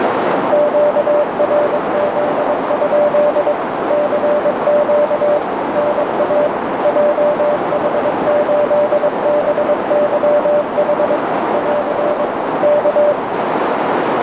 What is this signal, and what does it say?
Morse code, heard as a keyed tone, machine-sent, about 22 wpm, 590 Hz, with heavy radio static and a narrow filter. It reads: QRZ? CQ NA JH8BYH <AR> K